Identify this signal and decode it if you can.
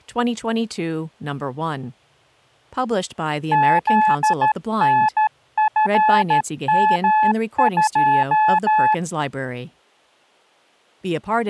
Morse code, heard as a keyed tone, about 13 wpm, 860 Hz, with speech in English. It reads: ZNFM2